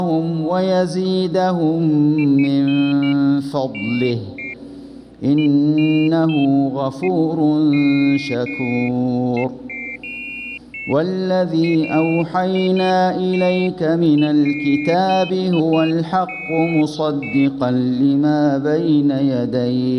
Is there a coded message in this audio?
No, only pairs of high tones at irregular times.